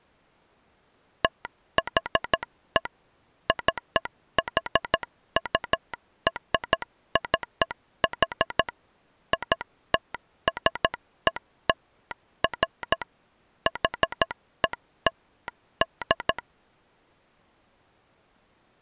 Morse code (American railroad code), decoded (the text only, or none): THE CHURCH ITSELF HELD